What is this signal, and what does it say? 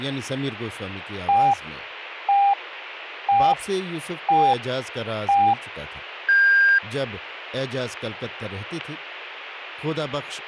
Radio time signal (five pips and a higher one, as on Chinese radio), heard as pips, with speech in Urdu.